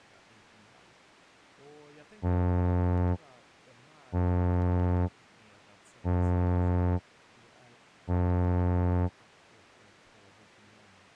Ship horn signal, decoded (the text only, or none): 4 short